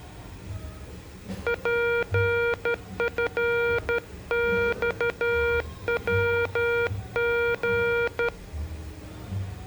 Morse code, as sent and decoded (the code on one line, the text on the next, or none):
.--. ..-. -..- .-- --.
PFXWG